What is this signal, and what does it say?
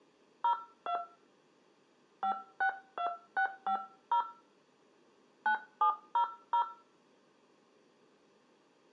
DTMF, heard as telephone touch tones, dialled by hand, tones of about 90 ms. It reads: 02 562650 9700